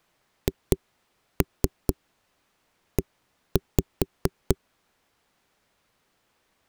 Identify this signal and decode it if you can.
Tap code, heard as knocks on a wall, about 4 knocks a second. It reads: HE